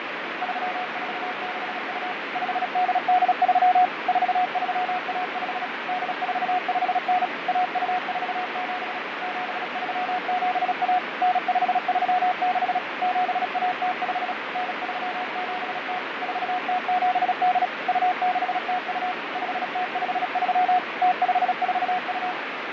Morse code (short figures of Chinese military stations), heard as a keyed tone, machine-sent, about 36 wpm, 730 Hz, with heavy radio static and fading. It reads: 3462 5883 4315 8459 1247 7371 9536 7105 9370 4078 2602 5053 0542